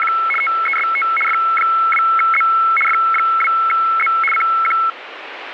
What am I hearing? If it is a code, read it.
RTTY (75 baud, 850 Hz shift), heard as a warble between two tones, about 1750 Hz centre, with radio static. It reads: … TEST F2Z F2Z CQ